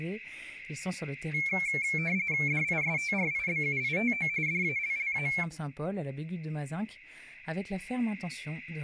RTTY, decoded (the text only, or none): DISTRIBUITO DALLA